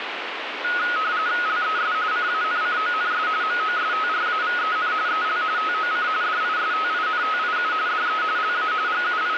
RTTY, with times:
1.5-1.9 LES
2.1-3.3 CANCONS
3.4-4.9 MOSTRAVEN
5.1-5.4 EL
5.6-6.1 TOC
6.2-7.7 DISTINTIU
7.9-8.2 DE
8.4-8.7 LA
8.9-9.4 …

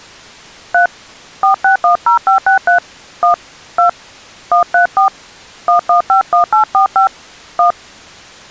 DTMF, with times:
0.7-0.9 3
1.4-2.8 4610563
3.2-3.3 1
3.8-3.9 2
4.5-5.1 134
5.7-7.1 1151845
7.6-7.7 1

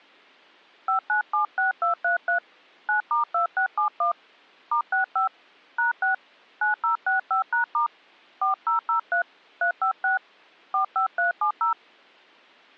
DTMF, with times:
0.9-2.4 5976233
2.9-4.1 9*2671
4.7-5.3 *65
5.8-6.1 #6
6.6-7.9 9065#*
8.4-9.2 4003
9.6-10.2 356
10.7-11.7 45370

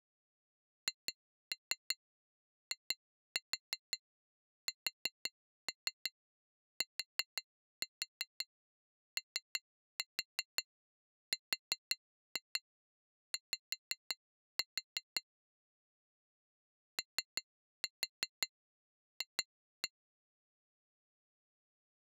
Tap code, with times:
0.9-15.2 HISTORY
17.0-19.9 OF

